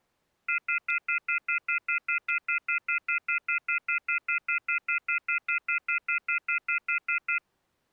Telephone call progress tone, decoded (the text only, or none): off-hook warning tone